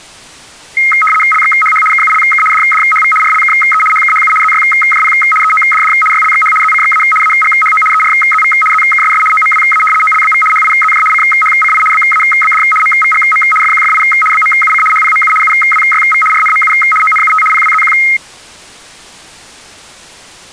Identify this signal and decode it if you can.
RTTY (75 baud, 850 Hz shift), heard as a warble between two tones, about 1700 Hz centre. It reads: LXHH KULK DDHV RLKE HKHU ZYJP EODD YLXH ZCXA AGHO ERZV ZKSS OMWA OLBV HIZJ CHCI BABD MVGM FQFI BMUC HPMU UWYV RNMU ONUT PWZQ